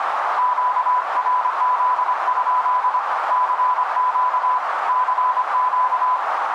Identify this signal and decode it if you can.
Morse code, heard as a keyed tone, hand-sent with a paddle, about 25 wpm, 1000 Hz, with radio static and a narrow filter. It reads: QRZ? CQ CQ